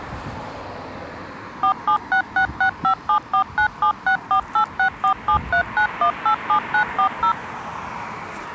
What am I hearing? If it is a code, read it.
DTMF, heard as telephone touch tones, dialled by machine, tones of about 90 ms, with street noise. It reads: 476665749764864739187940